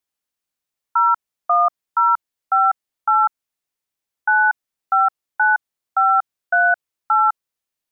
DTMF, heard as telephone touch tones, dialled by hand, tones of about 200 ms. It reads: 01058 959538